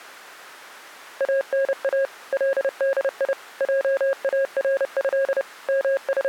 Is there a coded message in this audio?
Yes: Morse code (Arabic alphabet) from 1.1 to 6.3 s, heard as a keyed tone, machine-sent, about 30 wpm, 540 Hz. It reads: انا لدي جاره …